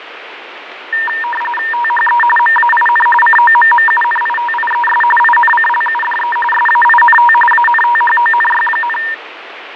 RTTY (45.45 baud, 850 Hz shift), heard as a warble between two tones, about 1380 Hz centre, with radio static and fading. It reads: THE MAIN COMMUNITIES INCLUDE SAINT ANTHONY,